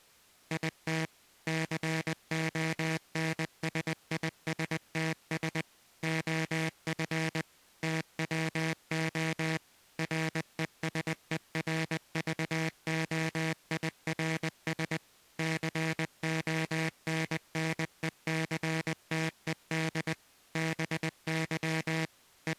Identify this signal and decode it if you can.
Morse code, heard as a buzzer, machine-sent, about 20 wpm. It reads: IT CONSISTS OF TWO RESERVOIRS CONNECTED BY …